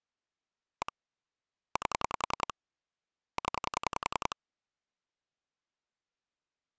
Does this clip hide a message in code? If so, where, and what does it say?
Yes: pulse dialling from 0.8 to 4.3 s, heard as clicks on a phone line, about 10 pulses a second. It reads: 1 8 0